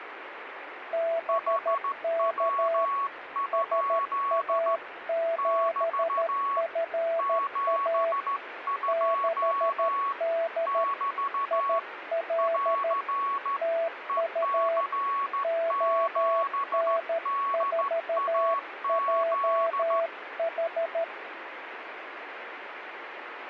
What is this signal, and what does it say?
Morse code, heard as two keyed tones, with radio static. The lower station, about 13 wpm, 660 Hz: BK SA7FA 6D IL TU ON4JH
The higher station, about 14 wpm, 1110 Hz: HW? <BT> 72 <BT> <AR> EC7DAZ